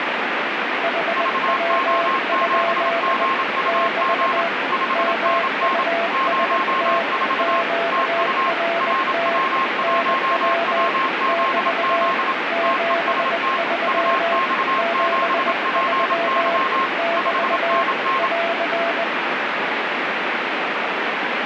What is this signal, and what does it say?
Morse code, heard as two keyed tones, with heavy radio static. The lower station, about 20 wpm, 680 Hz: HW? <BT> MUST QRT NW <BT> 73 73 <BT> <AR>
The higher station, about 27 wpm, 1070 Hz: VO7GUG 5NN 04 TU RW1WZZ TEST UX7PY 5NN